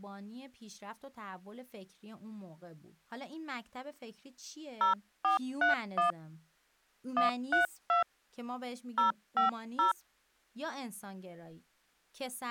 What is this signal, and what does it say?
DTMF, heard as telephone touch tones, dialled by hand, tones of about 130 ms, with speech in Persian. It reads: 0431 132 050